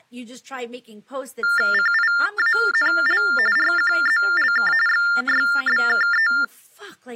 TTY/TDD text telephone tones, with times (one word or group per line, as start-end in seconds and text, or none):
1.7-3.2 CIANL
3.6-4.7 RQZLK
4.9-6.3 XYBKE